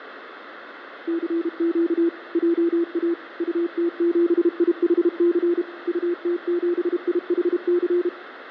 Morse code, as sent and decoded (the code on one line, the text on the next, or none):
-.-. --.- / .--- .- / ..- - --... .. .... -.-. / ..- - --... .. .... -.-.
CQ JA UT7IHC UT7IHC